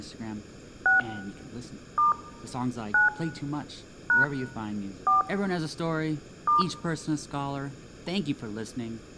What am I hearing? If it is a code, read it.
DTMF, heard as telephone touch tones, dialled by hand, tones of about 140 ms, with speech in English. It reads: 6 * 9 # 4 *